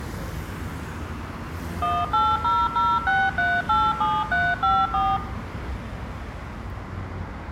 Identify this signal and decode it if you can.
DTMF, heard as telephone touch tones, dialled by machine, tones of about 230 ms, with street noise. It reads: 18006387354